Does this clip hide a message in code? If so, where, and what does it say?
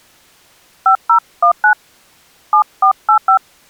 Yes: DTMF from 0.9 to 3.4 s, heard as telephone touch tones, dialled by hand, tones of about 90 ms. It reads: 5019 7485